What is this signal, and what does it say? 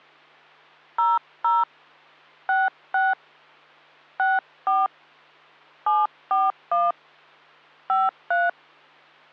DTMF, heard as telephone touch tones, dialled by hand, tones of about 190 ms, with hum. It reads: 00 66 64 741 53